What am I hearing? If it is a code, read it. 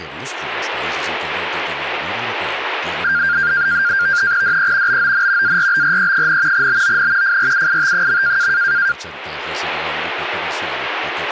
NAVTEX (SITOR-B), 100 baud, 170 Hz shift, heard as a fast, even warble, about 1500 Hz centre. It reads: DE BON ARBRE, BON FRUIT.